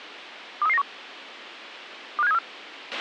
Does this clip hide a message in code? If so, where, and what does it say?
Yes: five-tone selective call (EEA) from 0.6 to 2.4 s, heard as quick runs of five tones, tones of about 40 ms, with a squelch burst at the end. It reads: 23391 25734